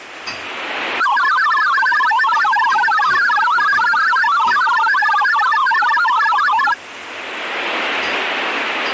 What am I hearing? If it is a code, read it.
Multi-tone FSK (Olivia or MFSK type), about 1000 Hz wide, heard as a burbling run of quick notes, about 62.5 baud, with kitchen noise.